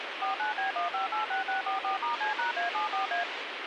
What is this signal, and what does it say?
DTMF, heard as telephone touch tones, dialled by machine, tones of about 130 ms, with radio hiss. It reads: 49B1586644*C#A74A